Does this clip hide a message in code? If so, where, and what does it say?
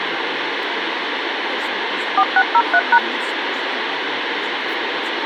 Yes: DTMF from 2.2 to 3.0 s, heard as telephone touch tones, dialled by machine, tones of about 60 ms, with radio hiss. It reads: 4603#